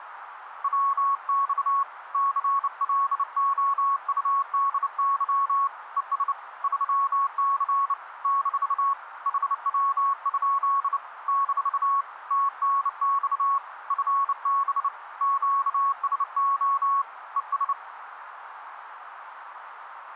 Morse code, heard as a keyed tone, hand-sent with a bug key, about 29 wpm, 1110 Hz, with radio static. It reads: WX CLOUDY ES 3C - HW? - TNX FB QSO ES